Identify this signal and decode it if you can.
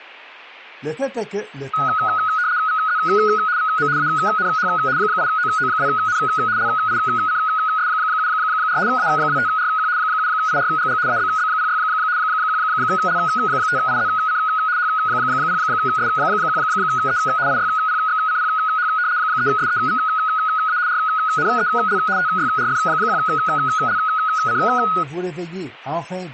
RTTY (75 baud, 170 Hz shift), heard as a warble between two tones, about 1360 Hz centre. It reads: VZ VM ANH 8OO2N LICS74 A25RQ 7IRGG ABB06 1L5IZC H0S1E IYPXCPH 3SEVA RNEL TYRF1LC